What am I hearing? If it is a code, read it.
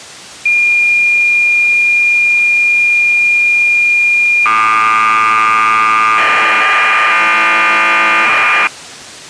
Cassette data (Kansas City type), 1200 baud, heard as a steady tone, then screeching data.